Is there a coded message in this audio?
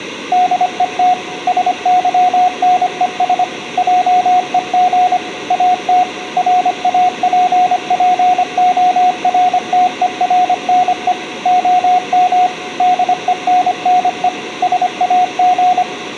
Yes: Morse code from 0.3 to 15.9 s, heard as a keyed tone, machine-sent, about 25 wpm, 730 Hz, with room echo. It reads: DET SYNES JEG AT RAPPORTERNE OM DENNE SAG